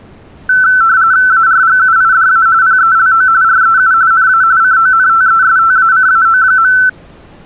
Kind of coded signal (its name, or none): RTTY